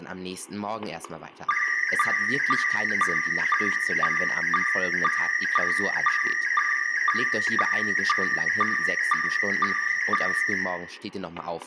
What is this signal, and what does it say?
SSTV (slow-scan television), PD 120, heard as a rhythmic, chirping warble, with static crashes, room echo and speech in German.